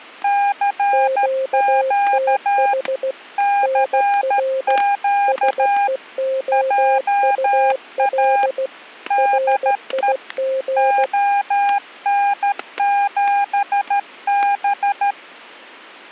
Morse code, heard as two keyed tones, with static crashes. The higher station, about 13 wpm, 810 Hz: CQ CQ JA DE ON7B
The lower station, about 16 wpm, 530 Hz: QTH NR SEOUL RIG